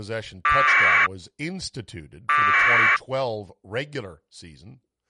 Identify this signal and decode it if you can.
Packet radio (AX.25, as in APRS), 1200 baud, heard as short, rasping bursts, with speech in English.